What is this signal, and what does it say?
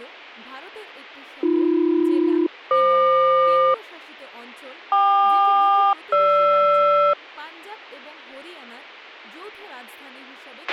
Aircraft SELCAL, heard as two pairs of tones, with a squelch burst at the end and speech in Bangla. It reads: AB-FQ KQ-GR